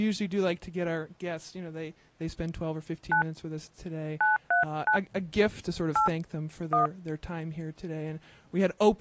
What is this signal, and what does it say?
DTMF, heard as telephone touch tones, dialled by hand, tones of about 120 ms, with speech in English. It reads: 9 939 8 1